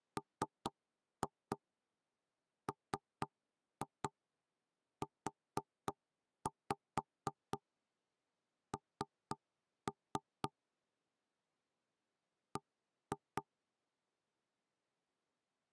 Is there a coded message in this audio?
Yes: tap code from 0.2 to 13.4 s, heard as knocks on wood, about 4 knocks a second. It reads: MMUN B